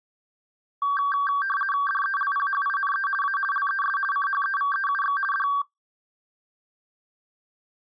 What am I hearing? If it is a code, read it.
RTTY (50 baud, 450 Hz shift), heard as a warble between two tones, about 1360 Hz centre. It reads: DELPHINE A LES CHEVEUX D